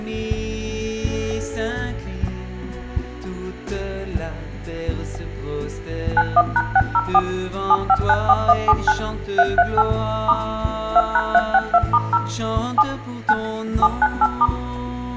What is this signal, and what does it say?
DTMF, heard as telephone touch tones, dialled by machine, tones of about 50 ms, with room echo. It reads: 91#604 7594179 338 * 2#362*0 7 9 798*